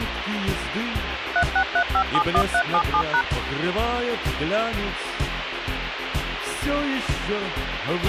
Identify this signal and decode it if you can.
DTMF, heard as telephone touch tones, dialled by machine, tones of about 80 ms, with radio hiss and a squelch burst at the end. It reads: 363571377#